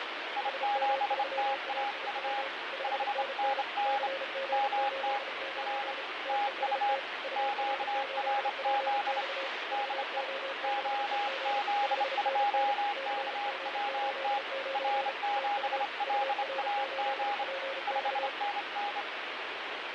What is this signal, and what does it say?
Morse code, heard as two keyed tones, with radio static. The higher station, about 28 wpm, 820 Hz: I7TAU 5NN MT R TU QRZ DE OZ2KWT R7LAG 5NN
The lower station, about 34 wpm, 540 Hz: SM3AIW 5NN CG89 TEST UR8PX VO6EG 5NN CG89 TU UR8PX